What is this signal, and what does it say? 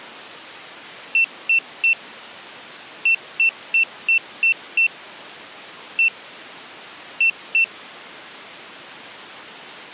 Beep code, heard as a piezo beeper, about 2700 Hz. 3-6-1-2.